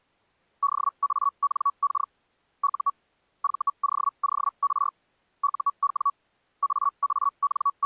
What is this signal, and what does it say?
Hellschreiber (Feld-Hell, 122.5 baud), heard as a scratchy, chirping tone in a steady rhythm, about 1130 Hz. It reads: DANK U VOOR UW …